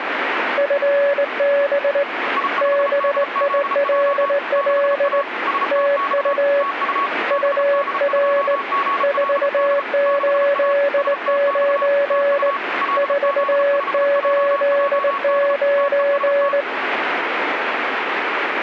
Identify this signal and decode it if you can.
Morse code, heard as two keyed tones, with radio static. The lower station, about 19 wpm, 570 Hz: FB BILL TU UR 489 489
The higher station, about 34 wpm, 1110 Hz: I5DZJ 6A STX TU BD2GLD 6A STX TU LZ5JJD TEST